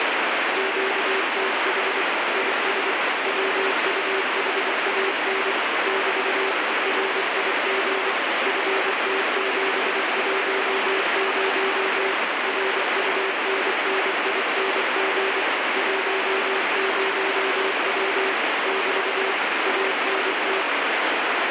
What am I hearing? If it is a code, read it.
Morse code, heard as a keyed tone, machine-sent, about 24 wpm, 390 Hz, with heavy radio static. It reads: QTH IS WUHAN <BT> RIG FT710 RUNNING 10W <BT> ANT